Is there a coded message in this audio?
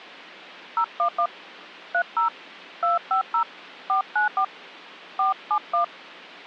Yes: DTMF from 0.8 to 5.8 s, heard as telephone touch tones, dialled by hand, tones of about 120 ms. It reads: 011 30 250 494 471